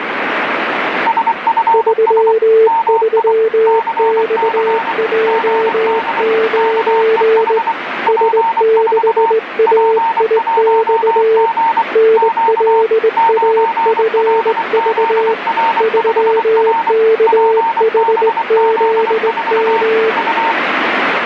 Morse code, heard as two keyed tones, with radio static. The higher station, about 24 wpm, 910 Hz: SFS MI CC GD KEH P4 P1G Q 9LZR5R PBZ4 U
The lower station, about 19 wpm, 440 Hz: 33XJ9 S6AIX NLAFV 3KHZM